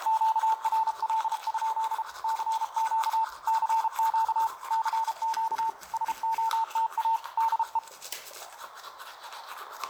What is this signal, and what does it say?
Morse code, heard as a keyed tone, hand-sent with a paddle, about 33 wpm, 900 Hz, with radio static and the noise of a restroom. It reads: QRL? CQ CQ CQ SOTA DE